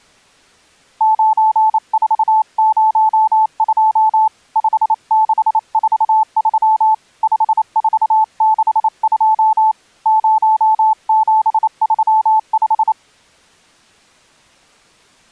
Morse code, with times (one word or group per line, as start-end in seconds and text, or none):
1.0-4.3 9402
4.6-6.9 5643
7.2-9.7 5462
10.1-12.9 0735